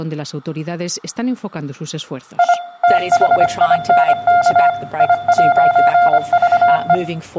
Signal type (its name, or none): Morse code